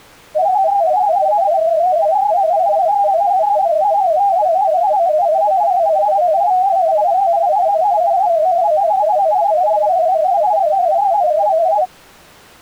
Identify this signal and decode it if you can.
Multi-tone FSK (Olivia or MFSK type), about 250 Hz wide, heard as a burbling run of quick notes, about 31.25 baud.